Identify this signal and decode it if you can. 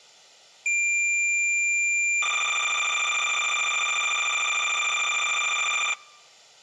Cassette data (Kansas City type), 300 baud, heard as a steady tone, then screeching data.